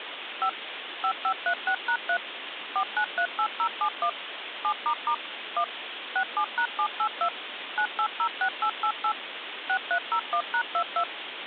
DTMF, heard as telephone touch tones, dialled by machine, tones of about 80 ms, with phone line noise. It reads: 5 5536#3 4938071 7** 1 67#782 9806888 6301#22